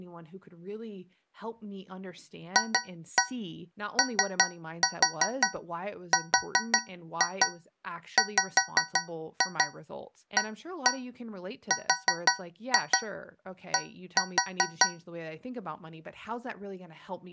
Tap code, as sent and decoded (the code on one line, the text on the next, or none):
2-1 3-4 4-2 5-2 1-1 4-2 1-4
FORWARD